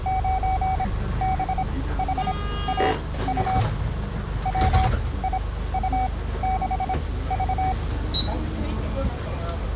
Morse code, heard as a keyed tone, machine-sent, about 26 wpm, spaced as for 16 wpm, 760 Hz, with the noise inside a bus. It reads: 9BHAU WIU6V